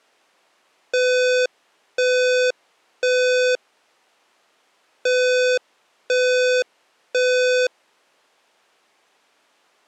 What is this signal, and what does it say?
Alarm pattern, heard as an alarm's beeps, played twice, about 500 Hz. Temporal three. Smoke or fire, evacuate.